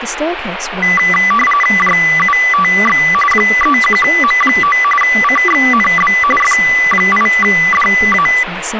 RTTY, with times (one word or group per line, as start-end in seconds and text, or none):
1.8-3.0 JUTX
3.3-4.8 31M9
5.0-6.1 CXNB
6.4-8.3 F8DA